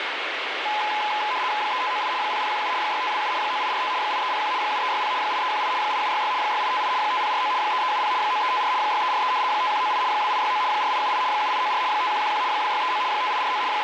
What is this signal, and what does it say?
RTTY (75 baud, 170 Hz shift), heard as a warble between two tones, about 930 Hz centre, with radio static. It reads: 3598 0017 6527 9845 8301 7360 8318 8766 6858 5049 3370 9354 6343 5198 2869 4878 7894 5111 2639 5849 …